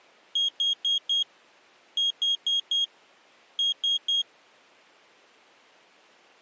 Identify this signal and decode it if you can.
Beep code, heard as a piezo beeper, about 3250 Hz. 4-4-3. In Phoenix BIOS tables: maths coprocessor failure.